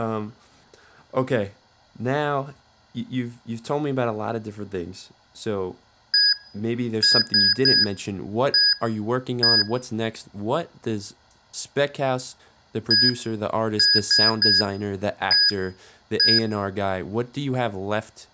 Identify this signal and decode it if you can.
Beep code, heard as beeps from a small speaker, played twice, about 1650 Hz, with room echo and speech in English. 1-3-1-1. In Phoenix BIOS tables: memory refresh test failure.